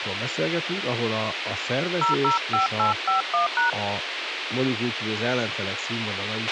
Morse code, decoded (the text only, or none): none